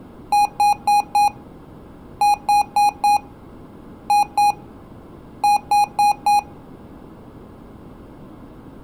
Beep code, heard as beeps from a small speaker, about 820 Hz. 4-4-2-4.